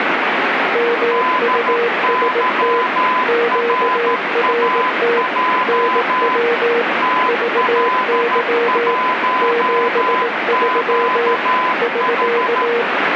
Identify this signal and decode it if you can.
Morse code, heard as two keyed tones, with heavy radio static. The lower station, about 18 wpm, 470 Hz: MUST QRT NW VY 73 <SK>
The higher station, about 13 wpm, 1010 Hz: DYRAJ TL1QH